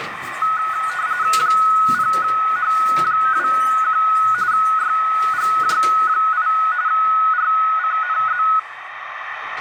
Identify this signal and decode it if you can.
RTTY (45.45 baud, 170 Hz shift), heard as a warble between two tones, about 1370 Hz centre, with radio static, a narrow filter and the noise inside a lift. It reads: 0H21 YGJ8 RCNZ